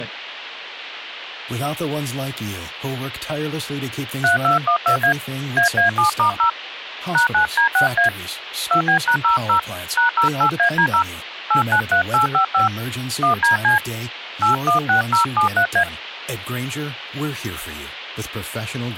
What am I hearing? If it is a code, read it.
DTMF, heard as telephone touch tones, dialled by hand, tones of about 110 ms, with hum and speech in English. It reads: 3212A AA7*0 #9D6A 2B#00 #08AD0 893855 1DC 816073A